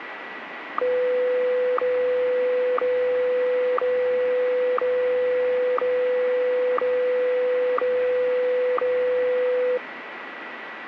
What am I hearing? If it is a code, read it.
Radio time signal (WWVH, Hawaii), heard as ticks, one a second, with radio static.